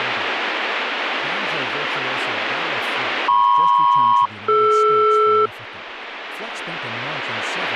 Aircraft SELCAL, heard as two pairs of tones, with speech in English. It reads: MP-DR